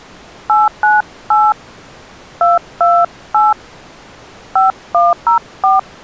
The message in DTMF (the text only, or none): 898 228 5104